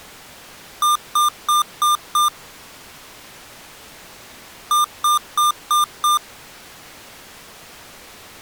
Beep code, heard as beeps from a small speaker, played twice, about 1200 Hz. 5 short. In AMI BIOS tables: processor failure; in Dell tables: CMOS battery failure.